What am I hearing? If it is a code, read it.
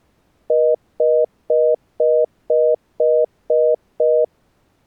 Telephone call progress tone (North American plan), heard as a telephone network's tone, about 480, 620 Hz, 0.25 s on and 0.25 s off. Congestion tone.